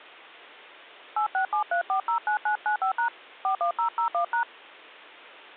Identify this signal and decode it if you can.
DTMF, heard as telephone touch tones, dialled by hand, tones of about 100 ms. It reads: 8673409995# 41001#